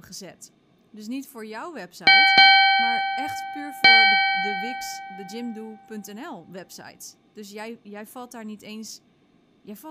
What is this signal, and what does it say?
Ship's bell, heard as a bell, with speech in Dutch. 3. Three half-hours of the watch have passed.